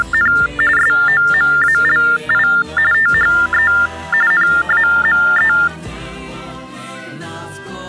TTY/TDD text telephone tones (45.45 baud Baudot), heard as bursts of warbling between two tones, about 400 Hz shift, 1600 Hz centre. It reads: … SOMALI THE NAME